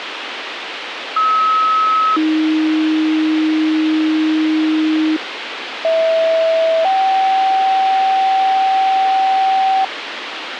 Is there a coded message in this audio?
Yes: two-tone page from 1.2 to 9.8 s, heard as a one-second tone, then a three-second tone, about 1290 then 310 Hz, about 650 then 770 Hz, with radio hiss.